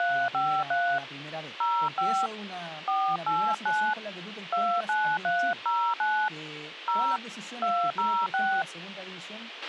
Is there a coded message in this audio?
Yes: DTMF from 0.0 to 8.6 s, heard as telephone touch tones, dialled by hand, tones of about 280 ms, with radio hiss, a squelch burst at the end and speech in Spanish. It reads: 353 05 489 29309 0 206